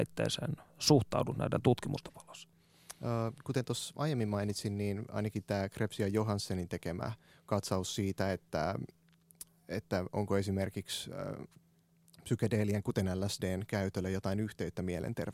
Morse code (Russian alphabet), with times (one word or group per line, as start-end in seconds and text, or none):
none